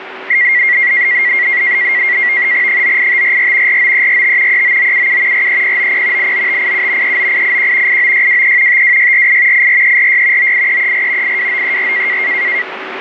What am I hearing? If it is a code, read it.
NAVTEX (SITOR-B), 100 baud, 170 Hz shift, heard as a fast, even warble, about 2050 Hz centre, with radio static and a steady whistle near 380 Hz. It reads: 98544 49345 39977 43090 89587 39881 89623 52648 84346 98334 82934